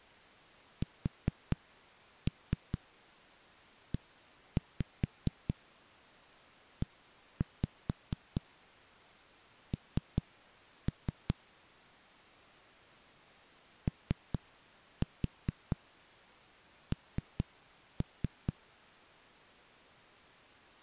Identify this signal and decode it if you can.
Tap code, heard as knocks on a wall, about 4 knocks a second. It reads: SEEN ON